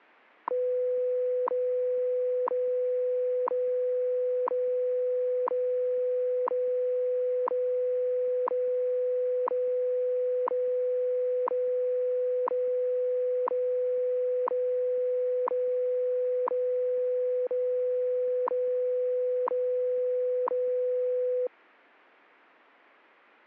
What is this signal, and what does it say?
Radio time signal (WWV, Colorado), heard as ticks, one a second.